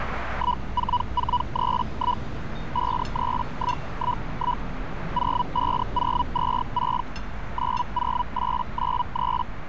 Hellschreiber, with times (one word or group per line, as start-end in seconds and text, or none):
0.3-2.2 14431
2.7-4.6 53111
5.1-7.0 05026
7.5-9.4 90893